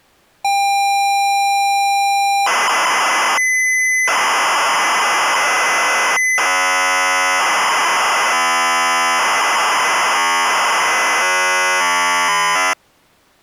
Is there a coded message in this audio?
Yes: ZX Spectrum tape loading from 0.4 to 12.7 s, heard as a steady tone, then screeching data.